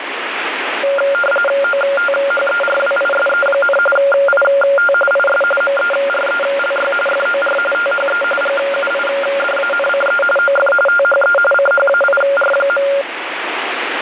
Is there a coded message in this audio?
Yes: RTTY (45.45 baud, 850 Hz shift) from 0.8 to 13.0 s, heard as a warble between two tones, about 980 Hz centre, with radio static. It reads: OTHERWISE, IT IS MERELY FOR THE GUIDANCE OF THE CHAIR.